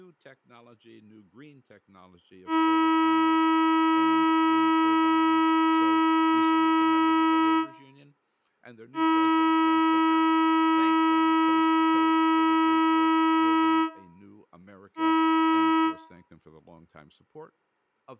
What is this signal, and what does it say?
Ship horn signal, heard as a ship's horn, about 320 Hz, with room echo and speech in English. 2 long, 1 short. At sea: I intend to overtake on your starboard side.